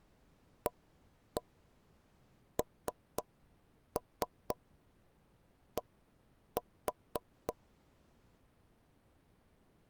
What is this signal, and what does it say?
Tap code, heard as taps on a table, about 3 knocks a second. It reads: AND